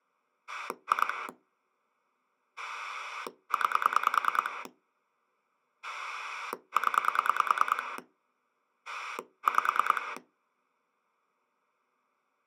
Pulse dialling, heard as a rotary dial, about 9 pulses a second. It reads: 2 9 0 5